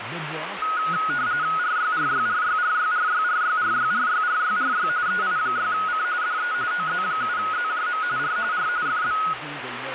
RTTY (45.45 baud, 170 Hz shift), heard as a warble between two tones, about 1360 Hz centre, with radio static and speech in French. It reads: RYRYRYRYRYRYRYRYRYRY EI6C DE OZ7ZJM R R FB